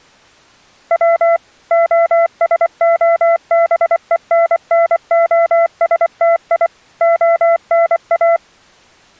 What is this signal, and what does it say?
Morse code (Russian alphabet), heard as a keyed tone, machine-sent, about 24 wpm, 670 Hz. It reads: В ОСОБЕННОСТИ ОНА